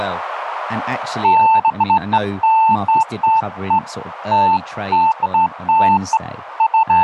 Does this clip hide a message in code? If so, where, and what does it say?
No, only beeps of irregular length, with radio static and speech in English.